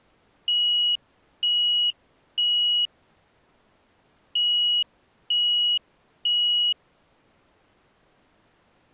Alarm pattern, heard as an alarm's beeps, played twice, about 2900 Hz. Temporal three. Smoke or fire, evacuate.